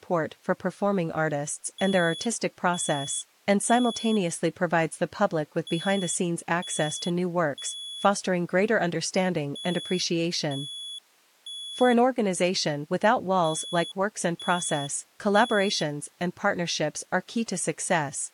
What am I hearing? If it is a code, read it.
Alarm pattern, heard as an alarm's beeps, played four times, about 3400 Hz, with speech in English. Temporal three. Smoke or fire, evacuate.